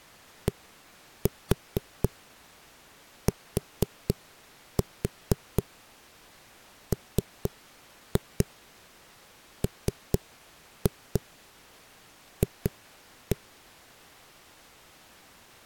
Tap code, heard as knocks on a wall, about 4 knocks a second. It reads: DTMMF